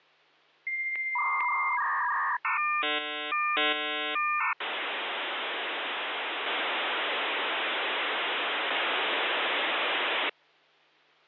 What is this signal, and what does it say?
Dial-up modem handshake (V.34 or later), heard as a whistle, warbles, then hiss.